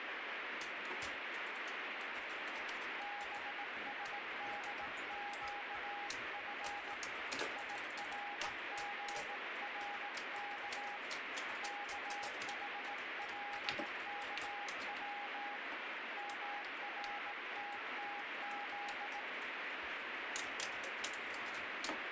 Morse code (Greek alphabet), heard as a keyed tone, hand-sent with a bug key, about 18 wpm, 820 Hz, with heavy radio static. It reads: ΒΣΔΨΦ ΙΡΓΡΚ ΚΗΛΚΩ ΜΡΤΤΖ